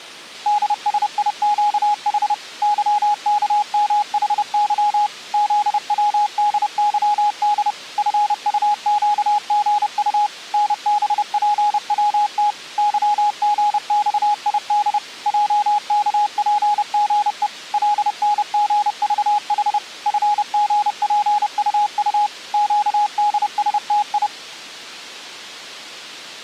Morse code, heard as a keyed tone, machine-sent, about 30 wpm, 830 Hz. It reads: DSIQH YKMHY ZWDYD FUQGU NBPWT YGXID JKPGE LNGVH FGPUU QDSTI